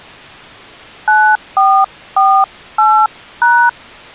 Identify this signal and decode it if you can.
DTMF, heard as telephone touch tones, dialled by hand, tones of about 280 ms. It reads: 9448#